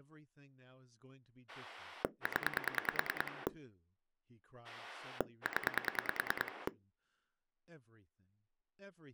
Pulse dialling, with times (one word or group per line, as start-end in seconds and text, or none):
1.5-3.5 0
4.6-6.7 0